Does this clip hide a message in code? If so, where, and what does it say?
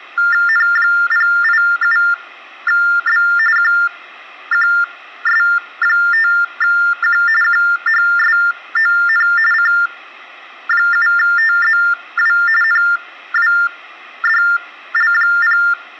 Yes: TTY/TDD text telephone tones (45.45 baud Baudot) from 0.2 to 15.7 s, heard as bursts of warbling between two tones, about 400 Hz shift, 1600 Hz centre. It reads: N087B QQS5Q QHSON C7TZW NWDL0